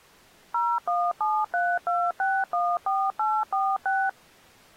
DTMF, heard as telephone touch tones, dialled by machine, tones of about 240 ms. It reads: 01732614846